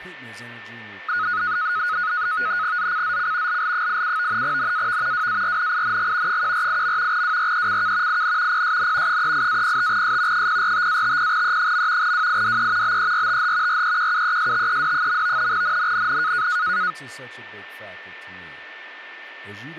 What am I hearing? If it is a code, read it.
NAVTEX (SITOR-B), 100 baud, 170 Hz shift, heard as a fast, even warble, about 1360 Hz centre, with a steady whistle near 1790 Hz and speech in English. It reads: ZCZC LL87 NAV WARNING 148. WRECK IN PSN 38-05S 045-50E. WIDE BERTH REQUESTED. NNNN